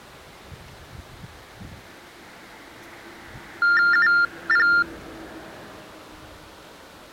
TTY/TDD text telephone tones (45.45 baud Baudot), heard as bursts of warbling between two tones, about 400 Hz shift, 1600 Hz centre, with street noise. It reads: UP